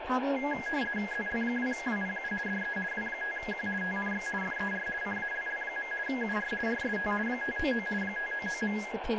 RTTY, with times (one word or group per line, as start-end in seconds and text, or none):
1.1-2.3 ZL2WPU
2.5-2.8 DE
2.9-3.7 W5Q
3.8-4.3 TNX
4.4-4.9 FER
5.0-5.9 CALL.
6.1-6.5 UR
6.7-7.1 RST
7.3-7.9 599
8.0-8.8 599.